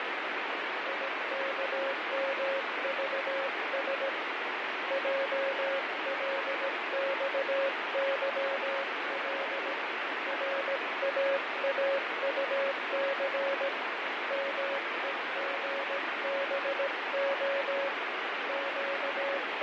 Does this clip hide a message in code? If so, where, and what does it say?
Yes: Morse code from 0.8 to 19.6 s, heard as a keyed tone, hand-sent with a paddle, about 17 wpm, 550 Hz, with heavy radio static and fading. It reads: IKMVS JLXYL RAAUC MEGBO …